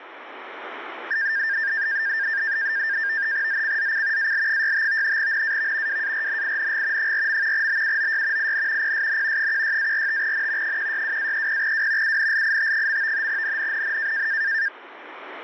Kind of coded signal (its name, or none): NAVTEX (SITOR-B)